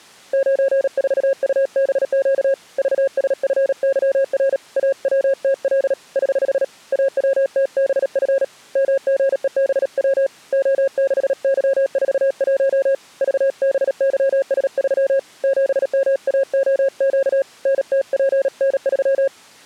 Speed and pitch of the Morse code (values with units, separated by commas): 37 wpm, 540 Hz